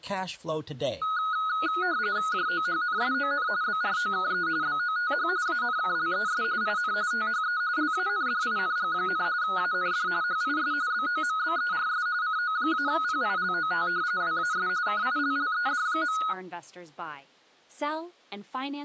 RTTY (45.45 baud, 170 Hz shift), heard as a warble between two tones, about 1360 Hz centre, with speech in English. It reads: JOHNSON BROKE BOTH ANKLES IN THE LANDING, AND HIS BOMBERS CO-PILOT WAS KILLED.